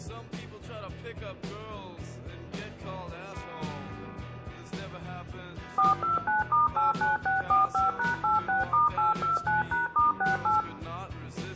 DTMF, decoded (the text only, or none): 429*89645#86*829#*68